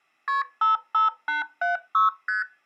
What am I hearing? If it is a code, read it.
Multi-frequency trunk signalling (R1, as on North American trunks), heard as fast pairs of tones, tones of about 140 ms. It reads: KP 55876 ST